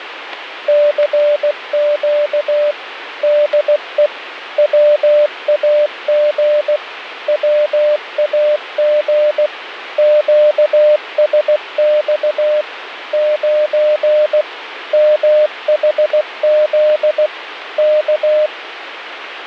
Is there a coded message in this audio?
Yes: Morse code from 0.6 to 18.5 s, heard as a keyed tone, machine-sent, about 16 wpm, 600 Hz, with radio static. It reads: CQ DE WAG WAG QSX 9 MHZ K